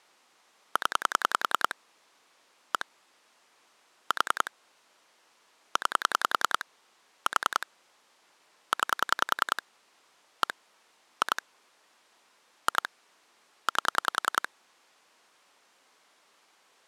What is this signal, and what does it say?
Pulse dialling, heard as clicks on a phone line, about 10 pulses a second. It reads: 0 1 4 9 4 9 1 2 2 8